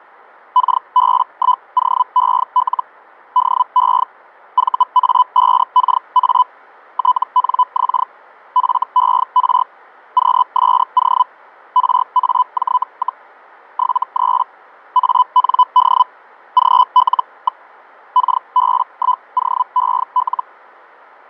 Hellschreiber (Feld-Hell, 122.5 baud), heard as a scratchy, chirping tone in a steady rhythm, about 1000 Hz, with fading. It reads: KB1OEL DE VA5KA TNX FER QSO RAJ, 73 AND GL. KB1OEL